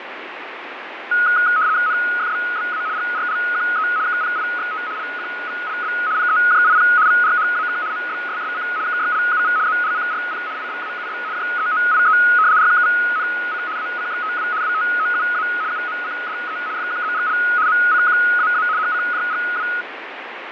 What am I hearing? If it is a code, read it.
RTTY (75 baud, 170 Hz shift), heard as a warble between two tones, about 1360 Hz centre, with radio static and fading. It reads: NFBBA GRLQE KPIXT LQVLB PEJIP VRHAK MBSSC KYLUV ZLCRP IBAUB JEOIE RKVNC ACXTW WTOUA UMCDE FQZGL MCQAA HCJGW